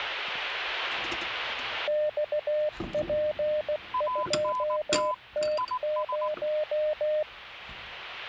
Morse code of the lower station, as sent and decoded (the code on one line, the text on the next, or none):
-..- .--. ..--- - -----
XP2T0